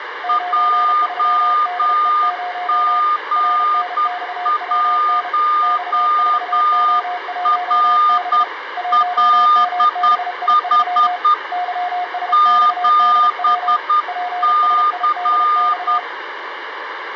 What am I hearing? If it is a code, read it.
Morse code, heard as two keyed tones, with radio static and room echo. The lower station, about 32 wpm, 720 Hz: 93DE0 RNXWN X4O1B 1MBI3 YSXDW PSIDX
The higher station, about 10 wpm, 1210 Hz: JG1RLH 7C